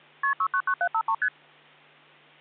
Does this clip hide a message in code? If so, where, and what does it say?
Yes: multi-frequency trunk signalling (R1, as on North American trunks) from 0.2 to 1.3 s, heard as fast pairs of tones, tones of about 70 ms, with hum. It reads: KP 699753 ST